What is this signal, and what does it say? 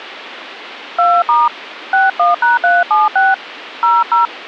DTMF, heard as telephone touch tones, dialled by hand, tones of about 180 ms. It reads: 2* 61#376 00